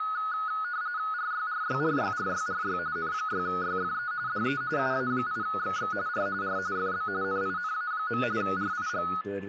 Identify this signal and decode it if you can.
RTTY (45.45 baud, 170 Hz shift), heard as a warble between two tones, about 1360 Hz centre, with a steady whistle near 1740 Hz and speech in Hungarian. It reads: RYRYRYRYRY N6YFE DE UA8XX R R FB NINA. RIG